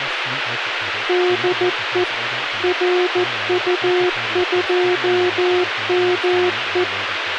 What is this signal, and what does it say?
Morse code, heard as a keyed tone, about 14 wpm, 360 Hz, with radio hiss and speech in English. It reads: DE RU2ME